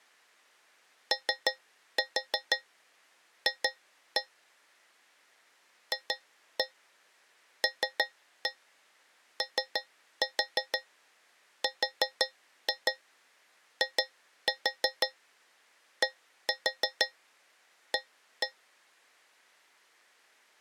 Tap code, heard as taps on a metal pipe, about 6 knocks a second. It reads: OF FLORIDA